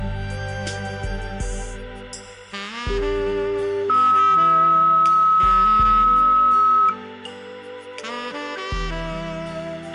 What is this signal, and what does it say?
Two-tone page, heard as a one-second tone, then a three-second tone, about 400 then 1290 Hz, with a squelch burst at the end and room echo.